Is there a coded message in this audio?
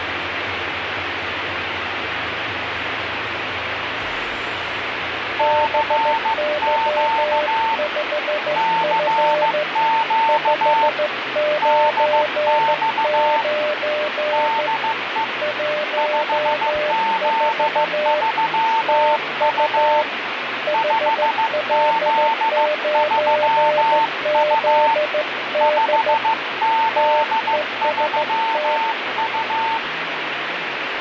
Yes: Morse code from 5.3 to 29.8 s, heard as two keyed tones, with radio static. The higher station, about 15 wpm, 900 Hz: CQ CQ DX DE 5Z3U 5Z3U 5Z3U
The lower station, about 14 wpm, 600 Hz: BY5F 599 14 TU HL9ZD TEST